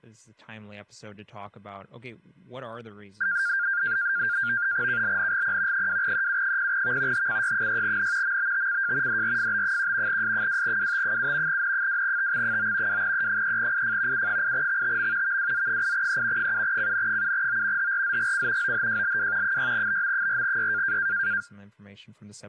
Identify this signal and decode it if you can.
NAVTEX (SITOR-B), 100 baud, 170 Hz shift, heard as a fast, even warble, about 1500 Hz centre, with speech in English. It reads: KLNGP 2EU0V HCY6N MBTCJ DRFB1 S2WT7 N2TX9 2E3IF U8XTM VWZ8E 7CN7O HRZGC OHJLW 6BM4Y